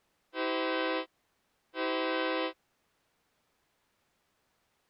Train horn signal, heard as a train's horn. 2 short. On North American railways: a signal is acknowledged.